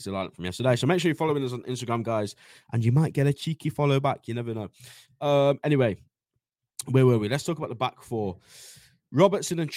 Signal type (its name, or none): none